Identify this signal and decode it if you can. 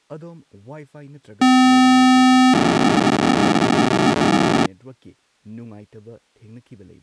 POCSAG pager data (512 baud), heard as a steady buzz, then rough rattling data, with speech in Manipuri.